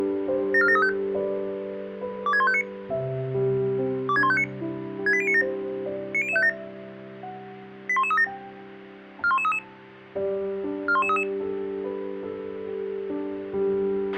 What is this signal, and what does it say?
Five-tone selective call (ZVEI), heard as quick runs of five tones, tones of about 70 ms, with a squelch burst at the end. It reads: 74735 26159 26159 68097 90057 81137 41133 41133